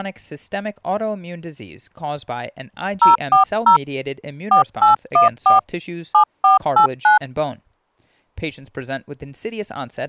DTMF, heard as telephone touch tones, dialled by hand, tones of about 120 ms, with speech in English. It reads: 040 4814 7489